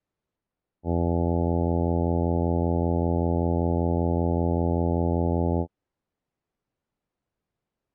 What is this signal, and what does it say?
Ship horn signal, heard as a ship's horn, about 80 Hz. 1 long. At sea: a vessel nearing a blind bend, or under power and making way in fog.